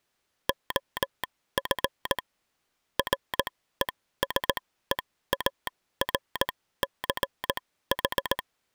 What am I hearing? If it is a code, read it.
Morse code, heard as a telegraph sounder, machine-sent, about 18 wpm, spaced as for 14 wpm. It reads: OF RESEARCH